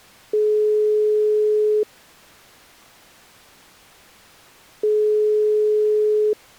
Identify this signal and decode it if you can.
Telephone call progress tone (single-tone plan, as in most of Europe), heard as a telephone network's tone, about 420 Hz, 1.5 s on and 3 s off. Ringback tone.